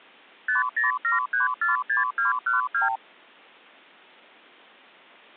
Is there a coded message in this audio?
Yes: multi-frequency trunk signalling (R2, with the far end's replies) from 0.5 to 3.0 s, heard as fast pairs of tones, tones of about 140 ms. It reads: 507346212